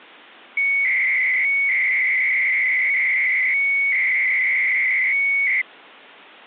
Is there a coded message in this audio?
Yes: 300-baud modem data (Bell 103 tones) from 0.6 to 5.6 s, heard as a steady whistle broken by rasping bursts, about 300 baud, 200 Hz shift.